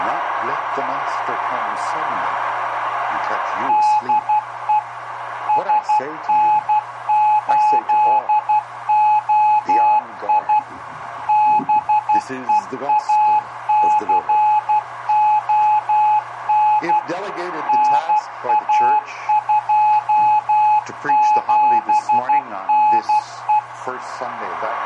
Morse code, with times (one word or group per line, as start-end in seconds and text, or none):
3.7-4.8 DE
5.5-10.6 SN8OI
11.3-17.0 BEACON
17.7-23.6 NA27NE